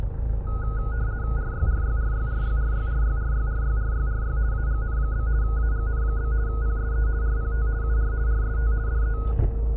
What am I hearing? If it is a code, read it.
RTTY (50 baud, 170 Hz shift), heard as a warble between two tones, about 1360 Hz centre, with the noise inside a car. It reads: RYRYRYRYRYRYRYRYRYRY AGN? AGN? PSE RPT UR RST DE